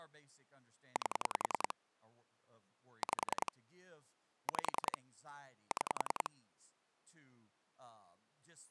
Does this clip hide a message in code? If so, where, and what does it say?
Yes: pulse dialling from 1.0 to 6.3 s, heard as clicks on a phone line, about 10 pulses a second, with speech in English. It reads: 8 5 5 6